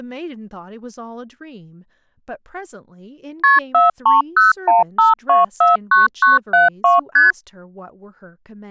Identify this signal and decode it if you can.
Multi-frequency trunk signalling (R1, as on North American trunks), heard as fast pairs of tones, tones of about 150 ms, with speech in English. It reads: KP 43015249972 ST